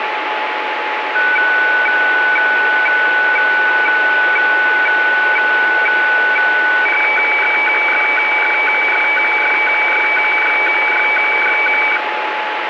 Weather fax (radiofax), 120 lines a minute, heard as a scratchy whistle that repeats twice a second, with radio static and a steady whistle near 850 Hz.